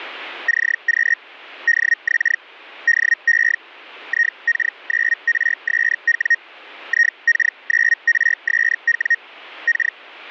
Hellschreiber (Feld-Hell, 122.5 baud), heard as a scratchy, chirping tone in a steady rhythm, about 1850 Hz. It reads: CQ DX DE IK9RSW IK9RSW K